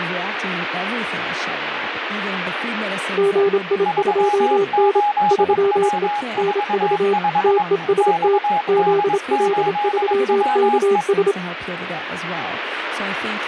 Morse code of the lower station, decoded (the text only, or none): GI2N 3E NV TEST ZL3KS